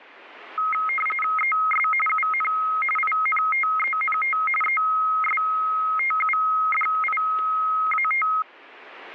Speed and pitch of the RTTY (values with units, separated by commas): 45.45 baud, 850 Hz shift, 1700 Hz centre